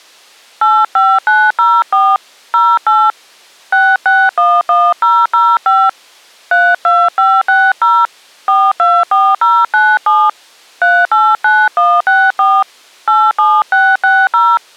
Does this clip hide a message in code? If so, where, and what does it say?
Yes: DTMF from 0.6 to 14.6 s, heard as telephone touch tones, dialled by hand, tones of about 240 ms. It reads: 85904 08 6611005 32560 424097 389164 87660